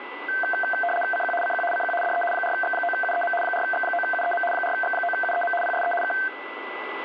RTTY (75 baud, 850 Hz shift), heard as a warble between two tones, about 1120 Hz centre, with radio static and a steady whistle near 1990 Hz. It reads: CQ CQ CQ DE 4X9UEM 4X9UEM 4X9UEM PSE K